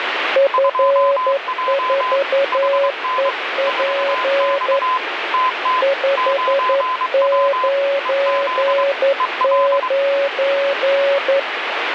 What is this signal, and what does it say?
Morse code, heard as two keyed tones, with heavy radio static. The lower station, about 11 wpm, 560 Hz: F4EP 599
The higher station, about 23 wpm, 1020 Hz: 2J HN 4X TT 9W EZ EL